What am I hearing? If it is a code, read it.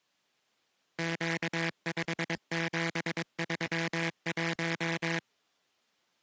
Morse code, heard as a buzzer, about 22 wpm. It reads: Q5731